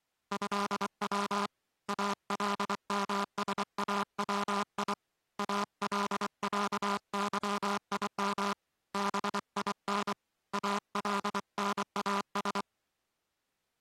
Morse code (Arabic alphabet), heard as a buzzer, hand-sent with a paddle, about 24 wpm. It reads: هو المساوي العظيم بين الناس